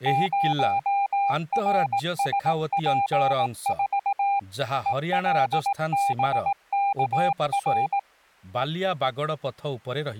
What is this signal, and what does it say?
Morse code, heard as a keyed tone, machine-sent, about 18 wpm, 800 Hz, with speech in Odia. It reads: 0RSP4 ELBKR